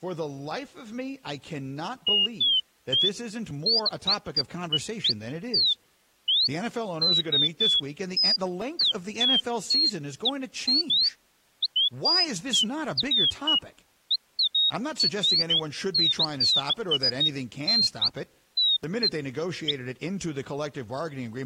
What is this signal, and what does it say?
Bird-like chirps, with speech in English. There is no code.